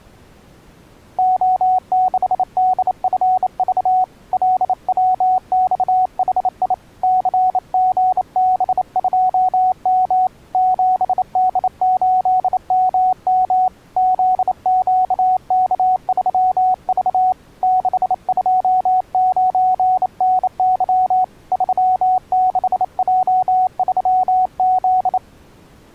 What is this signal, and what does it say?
Morse code, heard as a keyed tone, hand-sent with a bug key, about 28 wpm, 740 Hz. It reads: O6DFV LWXHI CGB2M 7D8MM ZQK3V 629NY 36J3Z